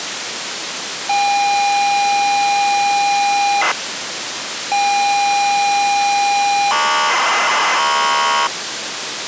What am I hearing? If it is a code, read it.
ZX Spectrum tape loading, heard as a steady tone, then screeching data, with tape hiss.